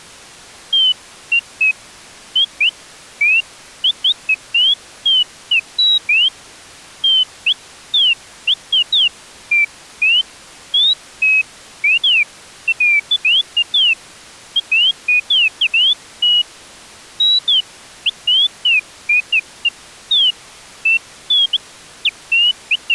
Bird-like chirps. There is no code.